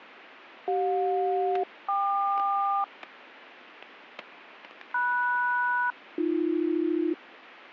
Aircraft SELCAL, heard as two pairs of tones, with static crashes. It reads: CJ-KQ MS-AB